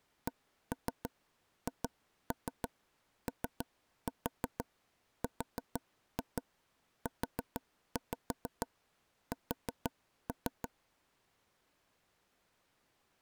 Tap code, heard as taps on a table, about 6 knocks a second. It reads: CHORUS